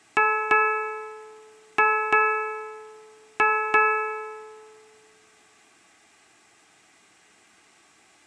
Ship's bell, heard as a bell, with room echo. 6. Six half-hours of the watch have passed.